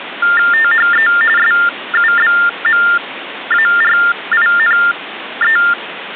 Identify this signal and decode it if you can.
TTY/TDD text telephone tones (45.45 baud Baudot), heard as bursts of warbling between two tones, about 400 Hz shift, 1600 Hz centre, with phone line noise. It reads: THE SUBMARINE